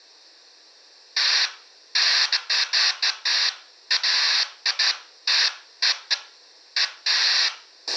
Bursts of noise, with a squelch burst at the end and room echo. There is no code.